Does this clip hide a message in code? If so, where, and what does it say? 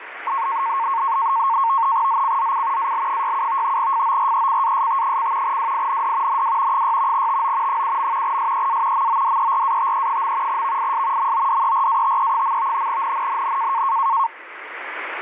Yes: NAVTEX (SITOR-B), 100 baud, 170 Hz shift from 0.3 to 14.3 s, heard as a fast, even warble, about 1000 Hz centre, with radio static. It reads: ZCZC AL67 FORECAST: WIND NW 6 TO 7. SEA MODERATE. VIS MODERATE. NNNN